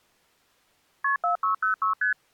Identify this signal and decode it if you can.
Multi-frequency trunk signalling (R1, as on North American trunks), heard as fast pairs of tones, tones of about 120 ms. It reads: KP 4606 ST